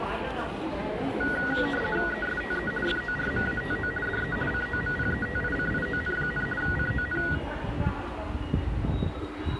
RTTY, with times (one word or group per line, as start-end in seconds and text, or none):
2.1-2.7 ESTE
2.9-3.9 FORMATO
4.1-4.4 DE
4.5-6.5 COMPETICION,
6.6-7.2 CON